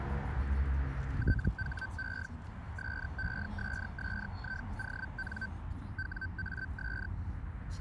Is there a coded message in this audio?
Yes: Hellschreiber (Feld-Hell, 122.5 baud) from 1.2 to 7.1 s, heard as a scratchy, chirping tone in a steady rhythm, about 1550 Hz, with radio static and the noise inside a car. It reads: THE SESSION WAS